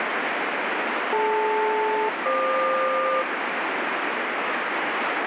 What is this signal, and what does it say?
Aircraft SELCAL, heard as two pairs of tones, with heavy radio static. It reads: DL-FQ